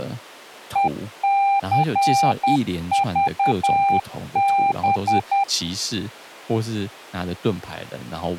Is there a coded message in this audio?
Yes: Morse code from 0.7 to 5.5 s, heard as a keyed tone, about 10 wpm, 790 Hz, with speech in Chinese. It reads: ECVB